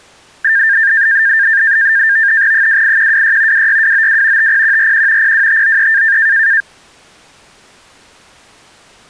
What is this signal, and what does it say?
NAVTEX (SITOR-B), 100 baud, 170 Hz shift, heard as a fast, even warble, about 1700 Hz centre. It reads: 28126 26292 50141 02593